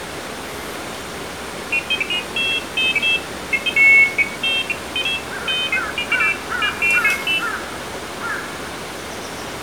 Pairs of high tones at irregular times, with room echo and the noise of a park. There is no code.